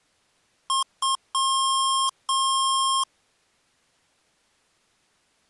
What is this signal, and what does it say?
Beep code, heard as beeps from a small speaker, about 1070 Hz. 2 short, 2 long.